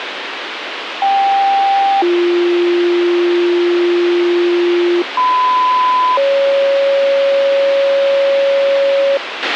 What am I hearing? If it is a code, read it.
Two-tone page, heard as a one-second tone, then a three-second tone, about 790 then 350 Hz, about 1010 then 550 Hz, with radio hiss and a squelch burst at the end.